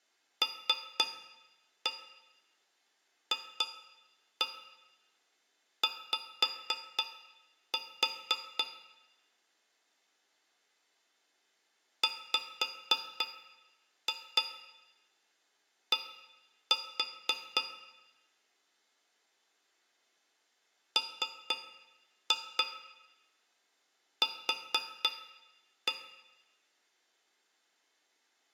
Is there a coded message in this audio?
Yes: tap code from 0.4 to 26.0 s, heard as taps on a metal pipe, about 4 knocks a second, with room echo. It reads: LFY WD MQ